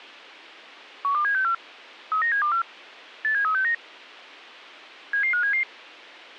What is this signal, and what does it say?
Five-tone selective call (CCIR), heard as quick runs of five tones, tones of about 100 ms. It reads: 12764 39724 87369 77577